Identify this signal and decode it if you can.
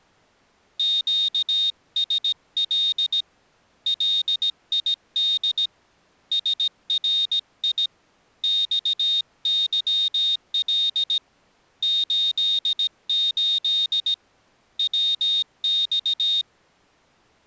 Morse code, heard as a high beeper, hand-sent with a paddle, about 17 wpm, 3700 Hz. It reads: QSL LID SRI XYL 88 WX